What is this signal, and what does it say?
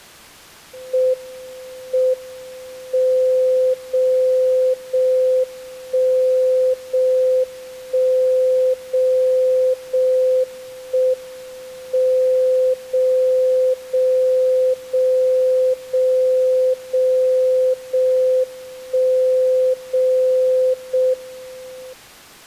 Radio time signal (JJY), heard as a tone whose level steps once a second, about 510 Hz. The time is 04:19 Japan time. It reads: M M 0 0 1 0 1 0 0 1 M 0 0 0 0 0 0 1 0 0 M